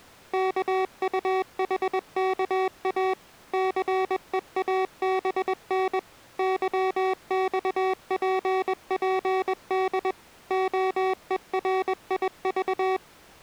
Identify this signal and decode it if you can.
Morse code, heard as electronic beeps, machine-sent, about 21 wpm, 380 Hz. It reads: KUHKA CEABN YXPPD OERIV